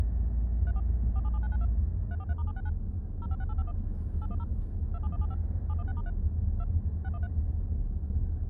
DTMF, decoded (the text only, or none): 34 477992 343*769 056851 810 27175 716*3 2 613